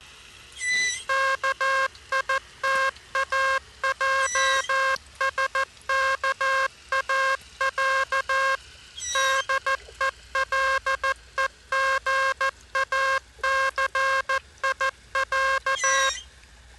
Morse code (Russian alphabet), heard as a buzzer, machine-sent, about 14 wpm. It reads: КИТАЙСКАЯ ДЕЛЕГАЦИЯ